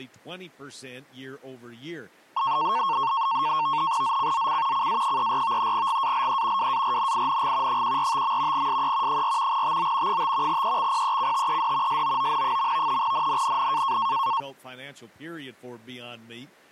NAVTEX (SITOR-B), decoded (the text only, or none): ZCZC CA34 GALE WARNING 145. SE 4 TO 5 EXPECTED SOON. NNNN